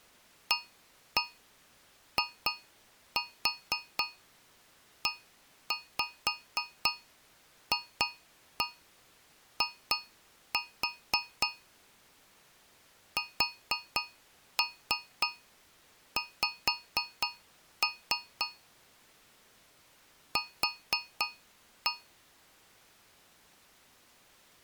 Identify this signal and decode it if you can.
Tap code, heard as taps on a metal pipe, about 4 knocks a second. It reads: AIEFI SX Q